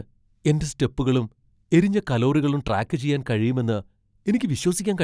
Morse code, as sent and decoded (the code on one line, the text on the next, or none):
none